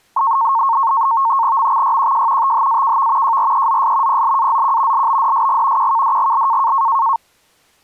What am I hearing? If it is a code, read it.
NAVTEX (SITOR-B), 100 baud, 170 Hz shift, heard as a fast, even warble, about 1000 Hz centre. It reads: MXYQJ THAKV JREZS PLAZQ LBDSG QKDGL